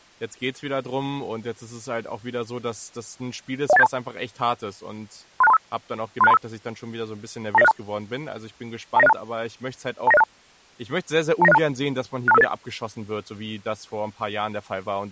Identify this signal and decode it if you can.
Five-tone selective call (EIA), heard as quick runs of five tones, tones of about 30 ms, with speech in German. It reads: 01872 36235 36235 29062 29062 29062 29062 62558